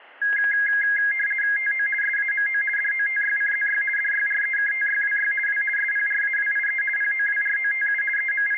RTTY (50 baud, 450 Hz shift), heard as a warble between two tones, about 1900 Hz centre, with static crashes. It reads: TO SAMO DOTYCZY DYREKTYWY W SPRAWIE POWROTU …